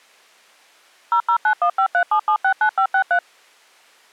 DTMF, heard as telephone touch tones, dialled by machine, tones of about 80 ms. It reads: 0091537769563